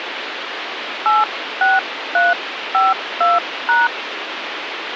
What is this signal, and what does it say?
DTMF, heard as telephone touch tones, dialled by hand, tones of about 180 ms, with phone line noise. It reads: 86352#